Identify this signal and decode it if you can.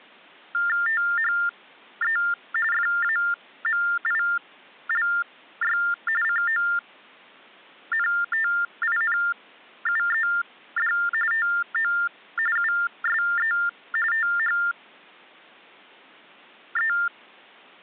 TTY/TDD text telephone tones (45.45 baud Baudot), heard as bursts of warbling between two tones, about 400 Hz shift, 1600 Hz centre. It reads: THE FAMILY CONTINUED TO USE THE